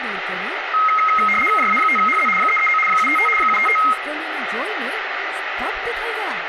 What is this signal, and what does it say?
RTTY (75 baud, 850 Hz shift), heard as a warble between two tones, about 1700 Hz centre, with radio static, room echo and speech in Gujarati. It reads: JA5HZ 339 755 755